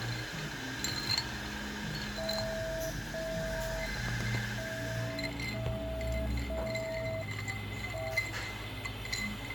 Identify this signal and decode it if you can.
Morse code, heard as a keyed tone, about 5 wpm, 650 Hz, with radio static, room echo and the noise of a cafe. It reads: MOE